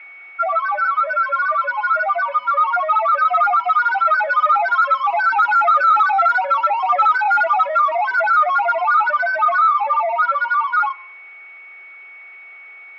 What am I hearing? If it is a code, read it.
Multi-tone FSK (Olivia or MFSK type), about 1000 Hz wide, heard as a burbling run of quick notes, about 31.25 baud, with a steady whistle near 2230 Hz.